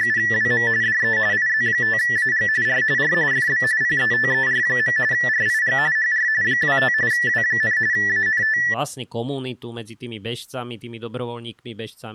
RTTY (45.45 baud, 170 Hz shift), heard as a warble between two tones, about 1850 Hz centre, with speech in Slovak. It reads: … DE IZ5AG R R FB PETER. RIG HR 25 W, ANT